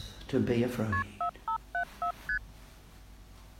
Multi-frequency trunk signalling (R1, as on North American trunks), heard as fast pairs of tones, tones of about 90 ms. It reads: KP 4574 ST